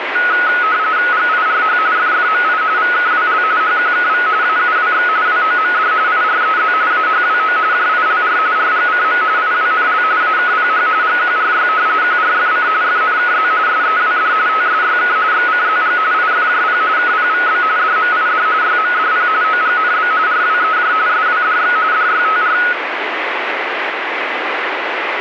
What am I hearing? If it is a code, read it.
RTTY (45.45 baud, 170 Hz shift), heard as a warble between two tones, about 1370 Hz centre, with radio static. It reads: GIRH FFMI VKWL HQKV AUWX WOMD IREZ AHWO JILR RGCM IWNL AKPH GQRY QRFC FNKZ SEWD TSYK XCZG IFJP KPVB DMID YMDP OGNB RWEJ SWDX DYTR